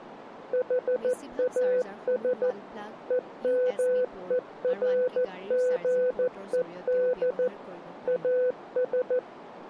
Morse code, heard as a keyed tone, machine-sent, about 14 wpm, 500 Hz, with radio static and speech in Assamese. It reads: HAS EMERGED AS